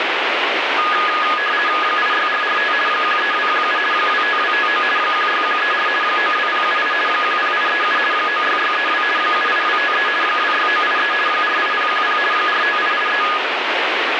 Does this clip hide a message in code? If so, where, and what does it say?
Yes: RTTY (50 baud, 450 Hz shift) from 0.8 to 13.4 s, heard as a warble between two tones, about 1460 Hz centre, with radio static. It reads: 86445 13217 25259 16134 92078 10837 96632 78253 26983 48010 45883